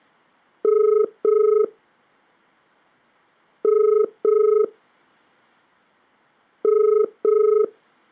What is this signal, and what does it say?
Telephone call progress tone (as in the UK, Ireland, Australia and similar networks), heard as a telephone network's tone, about 430 Hz. Ringback tone.